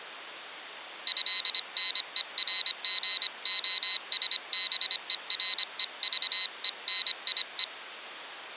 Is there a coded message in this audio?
Yes: Morse code (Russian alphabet) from 1.0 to 7.7 s, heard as a high beeper, hand-sent with a paddle, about 25 wpm, 3900 Hz. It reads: ЭНЕРГОСБЕРЕЖЕНИЕ